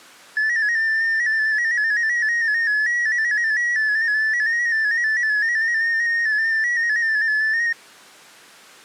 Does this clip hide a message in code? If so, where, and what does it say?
Yes: multi-tone FSK (Olivia or MFSK type), about 250 Hz wide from 0.4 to 7.7 s, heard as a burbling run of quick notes, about 15.625 baud.